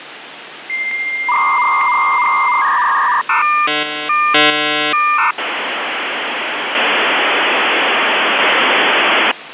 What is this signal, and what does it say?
Dial-up modem handshake (V.34 or later), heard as a whistle, warbles, then hiss, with phone line noise.